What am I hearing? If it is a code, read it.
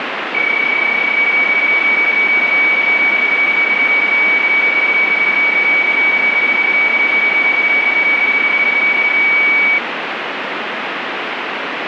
PSK31 (31.25 baud), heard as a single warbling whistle, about 2250 Hz, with radio static.